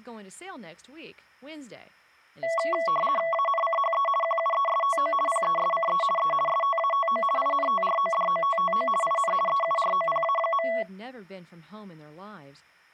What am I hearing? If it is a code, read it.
RTTY (50 baud, 450 Hz shift), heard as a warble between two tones, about 890 Hz centre, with speech in English. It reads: ANCHE QUESTO PESCE E STATO INTRODOTTO IN EUROPA.